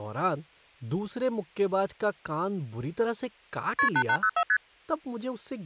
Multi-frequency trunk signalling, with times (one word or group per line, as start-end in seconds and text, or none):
3.8-3.9 KP
4.0-4.4 8804
4.5-4.6 ST